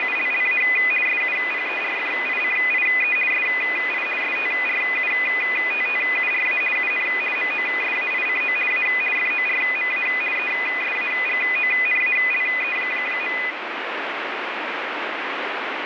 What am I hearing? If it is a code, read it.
RTTY (50 baud, 450 Hz shift), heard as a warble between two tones, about 2250 Hz centre, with radio static. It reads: … SUPERFICIE SI STRUTTURA UN MOSAICO A FORMA ESAGONALE.